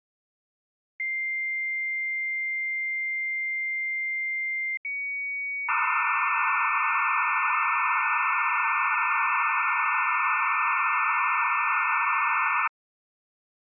Dial-up modem handshake (low-speed, two carriers), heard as two whistles, then hiss.